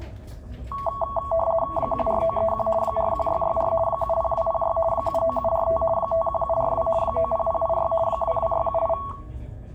RTTY (50 baud, 450 Hz shift), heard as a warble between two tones, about 880 Hz centre, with the noise of a crowd indoors. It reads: 14931 41664 70206 79745 51742 90086 22678